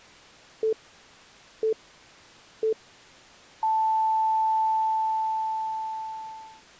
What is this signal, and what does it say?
Radio time signal (three low pips and a long one an octave up, as on NHK), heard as pips.